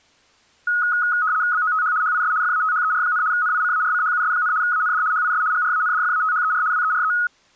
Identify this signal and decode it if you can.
RTTY (75 baud, 170 Hz shift), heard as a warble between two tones, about 1360 Hz centre. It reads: BOTH HIS FATHER, NICARCHUS, AND HIS GRANDFATHER WERE